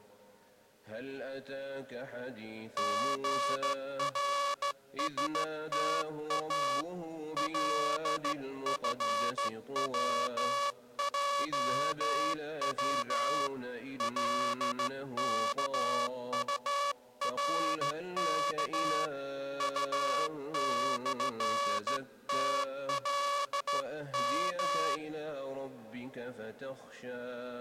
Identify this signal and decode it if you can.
Morse code, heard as a buzzer, hand-sent with a straight key, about 14 wpm. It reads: GRSTA LFWJW LKURK U/TLM